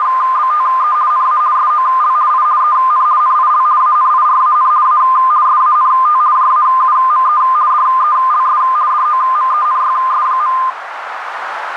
RTTY (50 baud, 170 Hz shift), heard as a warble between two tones, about 1130 Hz centre, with radio static and a narrow filter. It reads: … NA SOL I EN NIL ANIRAN A SANT JAUME DELS DOMENYS.